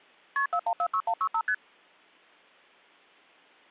Multi-frequency trunk signalling (R1, as on North American trunks), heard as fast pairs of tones, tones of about 70 ms. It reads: KP 4146165 ST